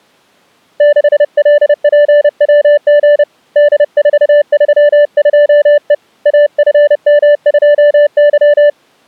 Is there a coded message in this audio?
Yes: Morse code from 0.7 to 8.8 s, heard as a keyed tone, hand-sent with a paddle, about 30 wpm, 590 Hz. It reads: 6LPWG D432E AFM2Y